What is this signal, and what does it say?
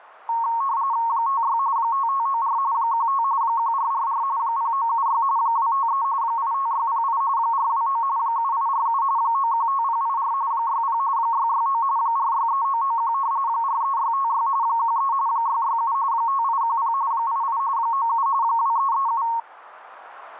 RTTY (45.45 baud, 170 Hz shift), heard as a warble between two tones, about 1010 Hz centre. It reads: 56 5594 15 1444 0976 253 85608 429 7847 915084 60 669 463991 43656 13 667 5810 88 97 2337